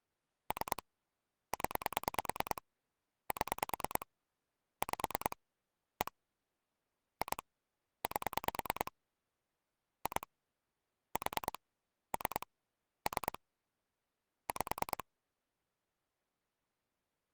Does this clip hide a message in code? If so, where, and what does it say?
Yes: pulse dialling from 0.5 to 15.0 s, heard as clicks on a phone line, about 9 pulses a second. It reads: 3 0 7 5 1 2 8 2 4 3 3 5